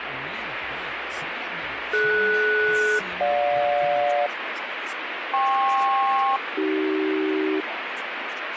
Aircraft SELCAL, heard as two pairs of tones, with radio static. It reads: DS-GJ KP-AC